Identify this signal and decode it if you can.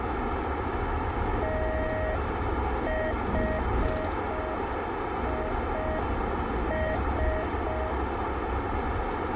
Morse code, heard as a keyed tone, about 5 wpm, 630 Hz, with heavy radio static, a narrow filter and the noise inside a bus. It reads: THIS